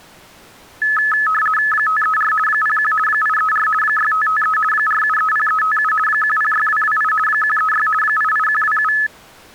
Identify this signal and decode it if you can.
RTTY (50 baud, 450 Hz shift), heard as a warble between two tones, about 1500 Hz centre. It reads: 534 01 834 6553 4730357 106228 136 88127